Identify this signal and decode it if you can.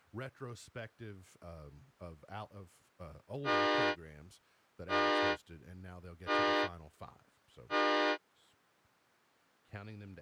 Train horn signal, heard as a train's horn, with speech in English. 4 short. On North American railways: a request for a signal to be given or repeated.